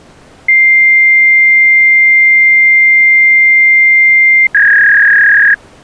Fax machine handshake, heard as a long tone and a warble.